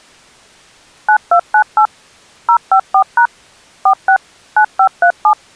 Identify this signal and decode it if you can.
DTMF, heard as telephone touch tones, dialled by machine, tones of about 80 ms. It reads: 9298 054# 46 9537